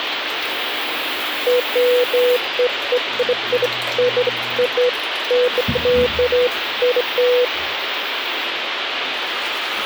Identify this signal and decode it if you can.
Beeps of irregular length, with phone line noise and the noise of a restroom. There is no code.